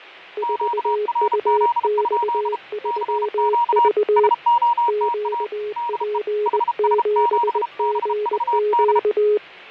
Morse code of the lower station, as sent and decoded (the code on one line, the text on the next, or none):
....- ..- -..- ...-- ...- / --.- .--. --... --. --.-
4UX3V QP7GQ